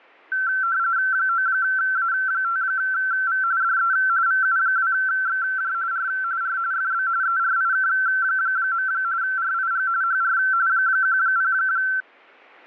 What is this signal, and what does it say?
RTTY (45.45 baud, 170 Hz shift), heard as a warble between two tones, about 1450 Hz centre. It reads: 9A5V DE VU2XJ R R FB ERIK. RIG HR 10